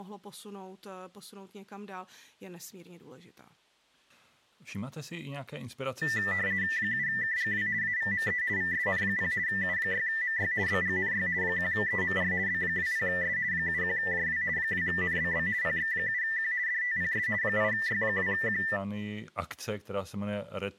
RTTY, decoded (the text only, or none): 7KGW AVME VSN0 U6MY BGNY 1EMR B20S 71JW 2NBB PX7Q DTPS 8Y2Q